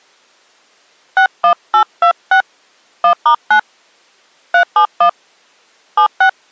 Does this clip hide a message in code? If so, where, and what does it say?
Yes: DTMF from 1.2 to 6.3 s, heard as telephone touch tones, dialled by hand, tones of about 90 ms. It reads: 61826 1*9 371 76